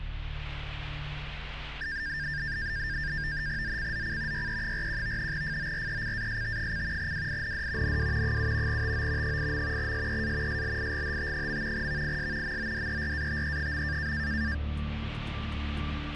NAVTEX (SITOR-B), 100 baud, 170 Hz shift, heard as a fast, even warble, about 1700 Hz centre. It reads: ZCZC YE41 FORECAST: WIND NW 7 TO 8. SEA SLIGHT. VIS MODERATE.